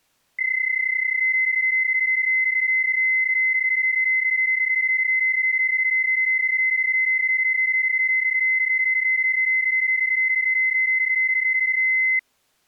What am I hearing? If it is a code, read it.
PSK31 (31.25 baud), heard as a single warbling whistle, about 2050 Hz.